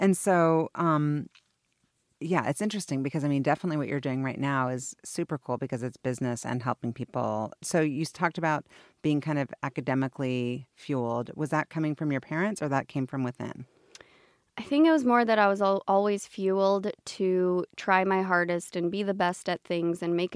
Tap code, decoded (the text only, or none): none